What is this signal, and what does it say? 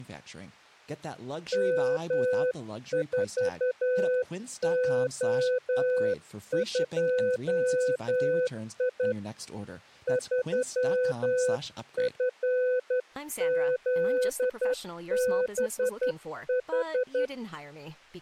Morse code, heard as a keyed tone, hand-sent with a straight key, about 11 wpm, 500 Hz, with speech in English. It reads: M4O2I 3FZBH